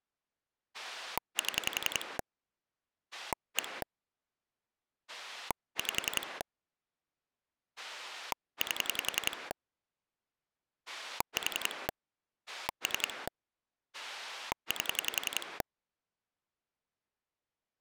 Pulse dialling, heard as a rotary dial, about 11 pulses a second. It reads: 7 1 5 8 4 3 8